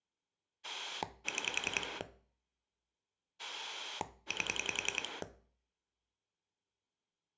Pulse dialling, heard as a rotary dial, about 10 pulses a second, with room echo. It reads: 6 8